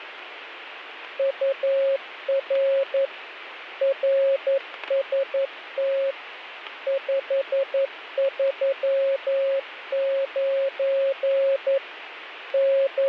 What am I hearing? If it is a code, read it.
Morse code, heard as a keyed tone, machine-sent, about 11 wpm, 540 Hz, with radio static. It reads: UR RST 539 …